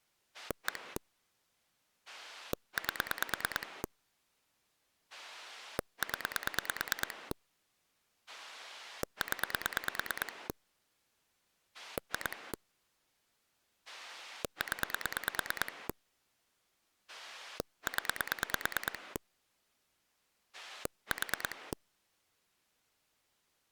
Pulse dialling, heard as a rotary dial, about 9 pulses a second. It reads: 1 8 0 0 2 0 0 4